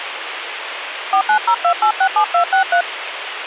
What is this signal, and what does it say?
DTMF, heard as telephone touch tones, dialled by hand, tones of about 90 ms, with radio hiss and a squelch burst at the end. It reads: 4902867263